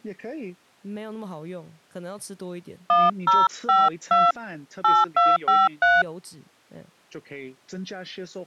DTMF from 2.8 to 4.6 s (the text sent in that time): 1052